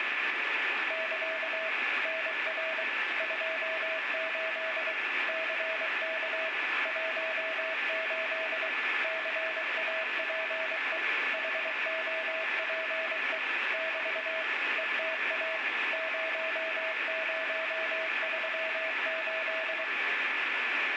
Morse code, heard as a keyed tone, machine-sent, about 23 wpm, 650 Hz, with radio static and a steady whistle near 1740 Hz. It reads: <KA> NR 28 CK 18 CAPE HOPE <BT> ETA 0038